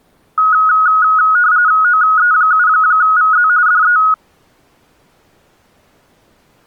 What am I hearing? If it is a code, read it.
RTTY (45.45 baud, 170 Hz shift), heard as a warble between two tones, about 1360 Hz centre. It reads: OE7VZ DE